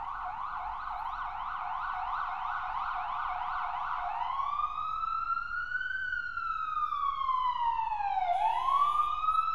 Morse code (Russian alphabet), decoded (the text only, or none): none